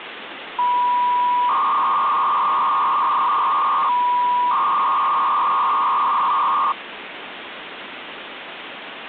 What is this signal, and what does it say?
300-baud modem data (V.21 tones), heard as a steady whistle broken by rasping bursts, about 300 baud, 200 Hz shift, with phone line noise.